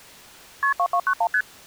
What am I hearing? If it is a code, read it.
Multi-frequency trunk signalling (R1, as on North American trunks), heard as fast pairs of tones, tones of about 70 ms. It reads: KP 2291 ST